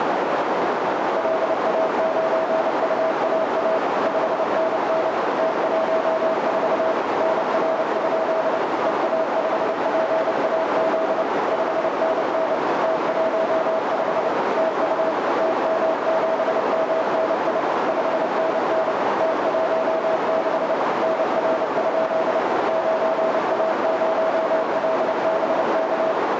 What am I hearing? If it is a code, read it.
Morse code, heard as a keyed tone, machine-sent, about 29 wpm, 650 Hz, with heavy radio static and a narrow filter. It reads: LA9UAA 5NN T14 NR? EA5PAZ 5NN T15 TU TM7MNI 5NN T16 NR? 9A0LBK